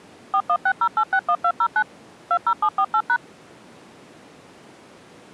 DTMF, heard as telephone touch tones, dialled by machine, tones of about 70 ms. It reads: 4160861209 20748#